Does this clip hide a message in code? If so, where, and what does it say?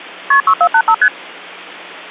Yes: multi-frequency trunk signalling (R1, as on North American trunks) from 0.3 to 1.1 s, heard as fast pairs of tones, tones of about 70 ms. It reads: KP 6485 ST